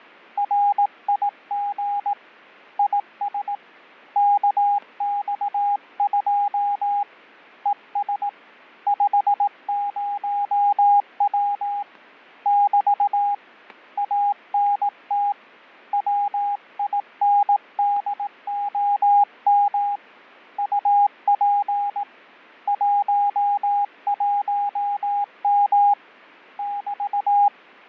Morse code, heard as a keyed tone, hand-sent with a paddle, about 18 wpm, 810 Hz, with fading and static crashes. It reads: RIG IS KX2 ES 50W <BT> ANT WINDOM UP 11M <BT>